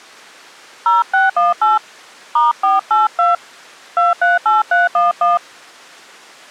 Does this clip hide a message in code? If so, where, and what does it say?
Yes: DTMF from 0.9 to 5.4 s, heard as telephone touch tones, dialled by hand, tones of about 160 ms. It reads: 0618 *482 238311